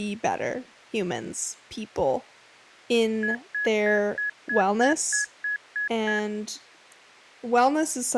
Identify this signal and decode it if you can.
Beep code, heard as beeps, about 1700 Hz, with speech in English. 10 short. In AMI BIOS tables: CMOS shutdown register error.